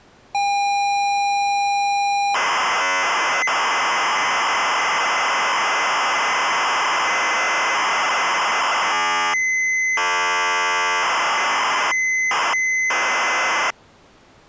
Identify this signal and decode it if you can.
ZX Spectrum tape loading, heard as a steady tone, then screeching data.